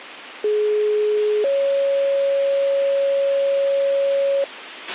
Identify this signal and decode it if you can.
Two-tone page, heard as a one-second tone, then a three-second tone, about 420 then 550 Hz, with radio hiss and a squelch burst at the end.